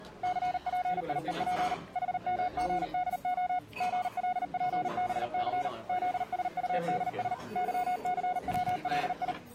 Morse code, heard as a keyed tone, machine-sent, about 39 wpm, 730 Hz, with the noise of a crowd indoors. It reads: CPIEP HMGDO GLPBC ZSUDS YCWLI